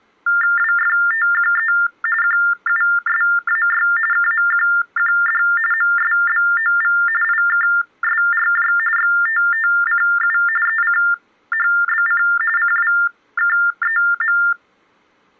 TTY/TDD text telephone tones (45.45 baud Baudot), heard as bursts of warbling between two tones, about 400 Hz shift, 1600 Hz centre. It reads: WFTQE QUSAY KMQQD MSBOV IKSRJ XTTCU ECHBC CWKEM